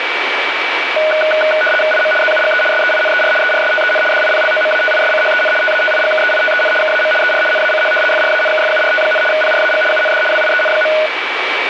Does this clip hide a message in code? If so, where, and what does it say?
Yes: RTTY (75 baud, 850 Hz shift) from 1.0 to 11.1 s, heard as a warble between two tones, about 1050 Hz centre, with radio static and a steady whistle near 2300 Hz. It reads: IM ZUGE SEINER ERSTEN DIPLOMATISCHEN TATIGKEITEN KAM ER NACH FRANKFURT, PRAG UND WIEN.